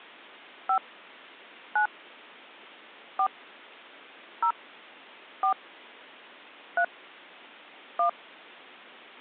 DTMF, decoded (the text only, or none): 5 9 4 0 4 3 1